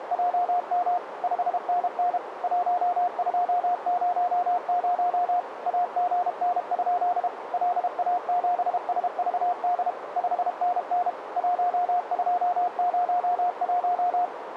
Morse code, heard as a keyed tone, machine-sent, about 32 wpm, 710 Hz, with radio static and a narrow filter. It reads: … 5NN 1200 AGN? LA7SVD 5NN 1201